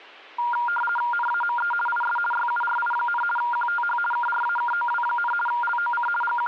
RTTY (50 baud, 450 Hz shift), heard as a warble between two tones, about 1180 Hz centre. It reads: NAME IS YURI, QTH KRAKOW, LOC …